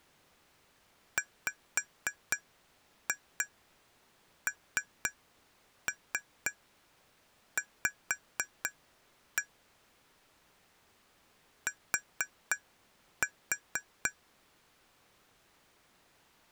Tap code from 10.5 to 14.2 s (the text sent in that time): T